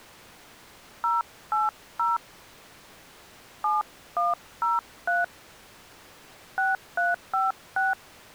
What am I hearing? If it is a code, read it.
DTMF, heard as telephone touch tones, dialled by hand, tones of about 170 ms. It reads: 080 7103 6356